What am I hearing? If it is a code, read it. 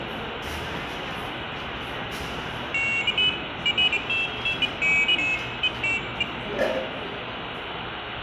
Pairs of high tones at irregular times, with phone line noise, room echo and the noise of a cafe. There is no code.